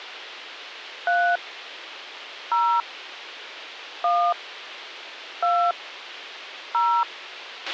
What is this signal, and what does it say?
DTMF, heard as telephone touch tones, dialled by hand, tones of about 280 ms, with a squelch burst at the end. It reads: 3 0 1 2 0